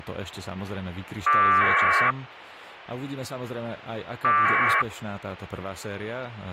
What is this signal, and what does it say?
Packet radio (AX.25, as in APRS), 1200 baud, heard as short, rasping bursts, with speech in Slovak.